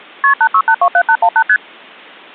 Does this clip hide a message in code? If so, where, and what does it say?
Yes: multi-frequency trunk signalling (R1, as on North American trunks) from 0.2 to 1.6 s, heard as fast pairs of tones, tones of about 70 ms. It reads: KP 86827818 ST